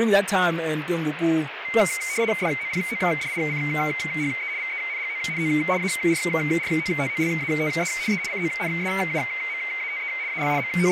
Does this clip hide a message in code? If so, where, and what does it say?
Yes: RTTY (75 baud, 170 Hz shift) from 1.6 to 10.9 s, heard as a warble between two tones, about 2150 Hz centre, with radio static and speech in English. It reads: DOPODICHE VENGONO ARROTOLATE E CONSUMATE AL …